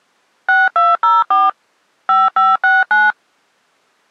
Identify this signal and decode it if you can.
DTMF, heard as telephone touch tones, dialled by machine, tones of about 190 ms. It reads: 6204 5569